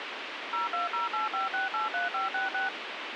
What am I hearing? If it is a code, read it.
DTMF, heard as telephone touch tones, dialled by machine, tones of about 150 ms, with radio hiss. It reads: 02085683566